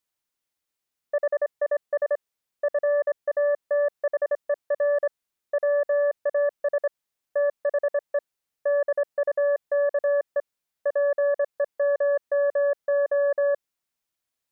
Morse code, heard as a keyed tone, hand-sent with a straight key, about 25 wpm, 580 Hz. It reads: HIS FATHER WAS THE DUKE PEMMO